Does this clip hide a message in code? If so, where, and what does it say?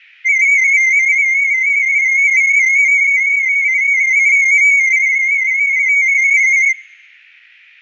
Yes: multi-tone FSK (Olivia or MFSK type), about 250 Hz wide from 0.2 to 6.8 s, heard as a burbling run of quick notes, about 31.25 baud.